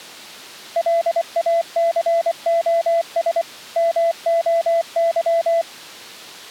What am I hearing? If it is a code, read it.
Morse code (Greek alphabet), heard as a keyed tone, machine-sent, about 24 wpm, 670 Hz. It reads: ΛΑΘΟΣ ΜΟΥ